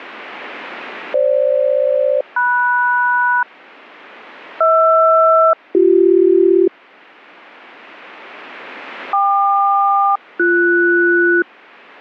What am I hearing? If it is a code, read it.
Aircraft SELCAL, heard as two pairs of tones. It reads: FG-MS HR-BC KQ-BS